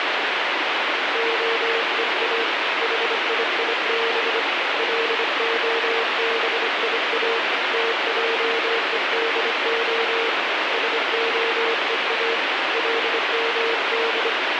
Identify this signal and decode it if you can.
Morse code (Hebrew alphabet), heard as a keyed tone, hand-sent with a bug key, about 25 wpm, 460 Hz, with heavy radio static. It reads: הוא חייב להביא תעודה שהוא למד